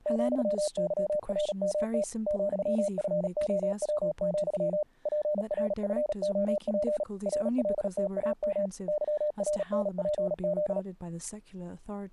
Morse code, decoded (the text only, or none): ,YRMT ,FOW, PRFOP RLTAM YRNPZ